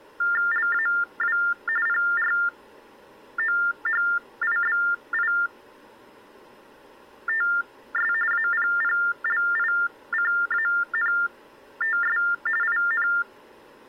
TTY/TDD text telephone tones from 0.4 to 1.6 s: LAW

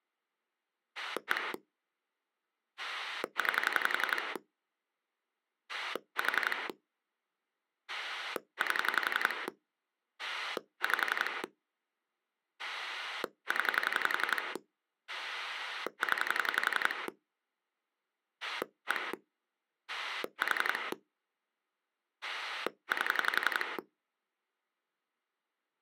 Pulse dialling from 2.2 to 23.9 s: 9 4 8 5 0 0 1 4 8

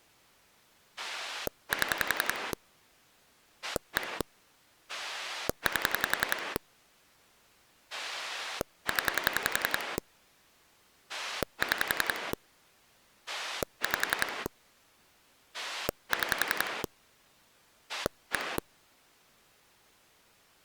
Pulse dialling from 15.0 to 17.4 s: 6

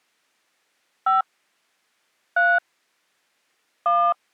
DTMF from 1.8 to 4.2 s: 3 1

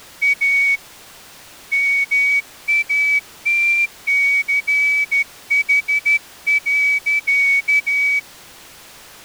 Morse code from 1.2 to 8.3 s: MATCH.

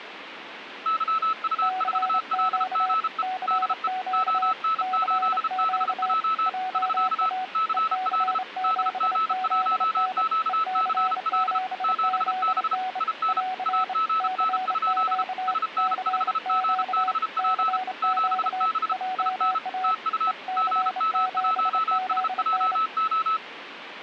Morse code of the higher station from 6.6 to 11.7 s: <SK> CL DG1QCL

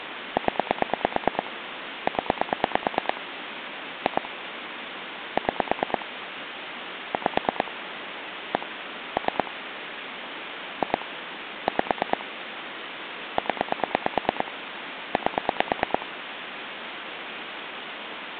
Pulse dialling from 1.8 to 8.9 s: 0 2 6 5 1

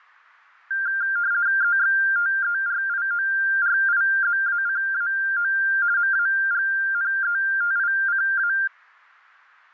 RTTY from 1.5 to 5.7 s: EXTERIORIZACAO

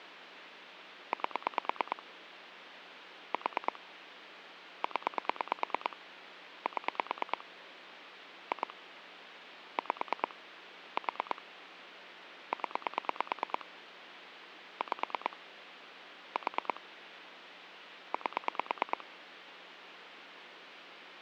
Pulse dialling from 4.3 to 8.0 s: 0 7

